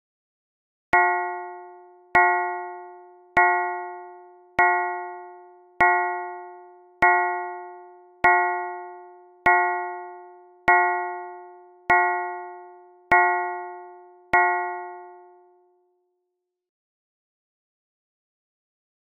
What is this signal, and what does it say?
Clock strike, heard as a bell. 12. Twelve o'clock.